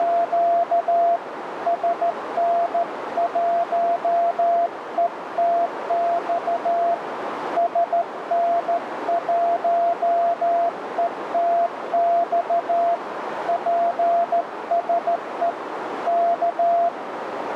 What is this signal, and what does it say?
Morse code, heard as a keyed tone, hand-sent with a straight key, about 14 wpm, 690 Hz, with radio static and a narrow filter. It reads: … SN1ETX SN1ETX PSE K